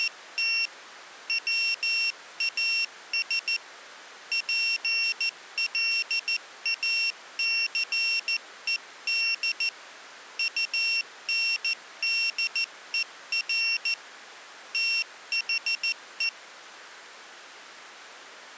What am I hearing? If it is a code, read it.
Morse code, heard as a high beeper, hand-sent with a paddle, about 14 wpm, 2750 Hz. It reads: … WAS PLACED UNDER THE